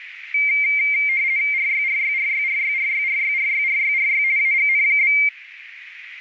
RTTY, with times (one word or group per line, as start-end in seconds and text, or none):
1.5-4.2 RYRYRYRYRYRYRYRYRY
4.4-5.1 AGN?